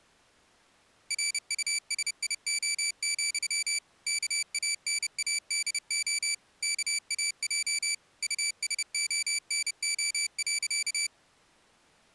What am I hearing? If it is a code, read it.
Morse code, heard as a high beeper, machine-sent, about 30 wpm, 2300 Hz. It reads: RUSIO, KANADO KAJ USONO.